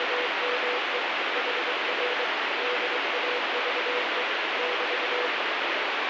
Morse code, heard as a keyed tone, machine-sent, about 23 wpm, 490 Hz, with heavy radio static. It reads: … HR DAVE <BT>